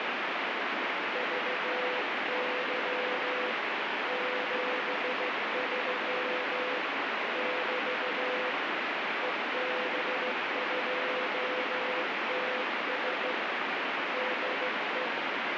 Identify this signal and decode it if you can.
Morse code, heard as a keyed tone, hand-sent with a straight key, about 15 wpm, 500 Hz, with heavy radio static. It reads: VY 73 <BT> EB2TS DE